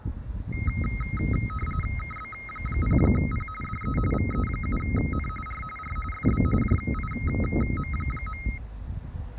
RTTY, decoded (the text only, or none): KB0P DE VE7N R R FB JIM.